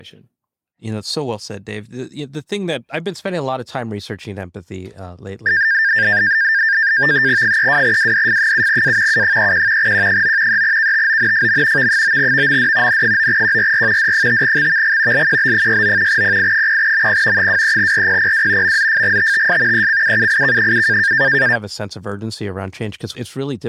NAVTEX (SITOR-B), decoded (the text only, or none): 32WDF7A U31 Q9 3KTONFM V9VMD N9QRR D5XVG LQB69 PI0MP 23RPPW MZFGTTS ECUUIK7